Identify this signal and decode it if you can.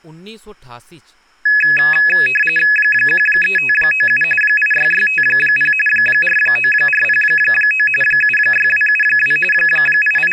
RTTY (45.45 baud, 850 Hz shift), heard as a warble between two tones, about 2100 Hz centre, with speech in Dogri. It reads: 13597 86650 49409 76272 …